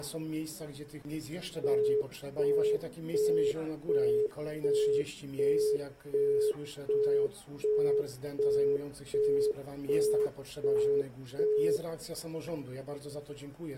Telephone call progress tone (as in the UK, Australia and similar networks), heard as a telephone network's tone, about 420 Hz, 0.375 s on and 0.375 s off. Busy tone.